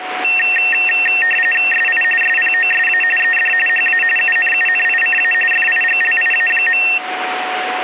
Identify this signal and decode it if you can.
RTTY (45.45 baud, 850 Hz shift), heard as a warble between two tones, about 2250 Hz centre, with radio static and a steady whistle near 740 Hz. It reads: SI SPOSA ED HA UNUNICA FIGLIA.